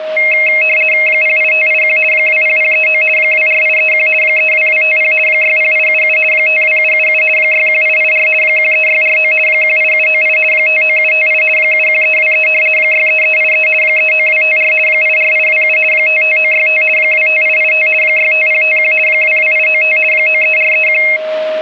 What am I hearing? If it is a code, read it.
RTTY (50 baud, 450 Hz shift), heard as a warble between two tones, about 2350 Hz centre, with a steady whistle near 630 Hz. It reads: 08581 20039 24831 32250 60877 52777 61884 13649 18798 59758 71323 63383 39254 84827 55965 25885 65051 22895 93431